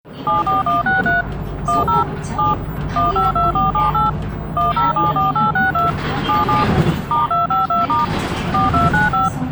DTMF, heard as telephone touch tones, dialled by machine, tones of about 160 ms, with the noise inside a bus. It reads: 74163 10 7 152478 1074862 77 *252* 4295